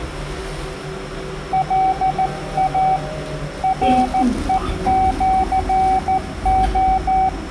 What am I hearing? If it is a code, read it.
Morse code (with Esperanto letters), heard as a keyed tone, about 14 wpm, 760 Hz, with room echo and the noise inside a lift. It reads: LA REĜO